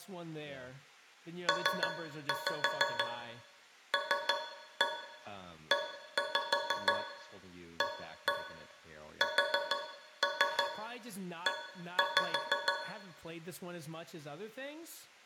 Tap code, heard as taps on a metal pipe, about 6 knocks a second, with room echo and speech in English. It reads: PLEASE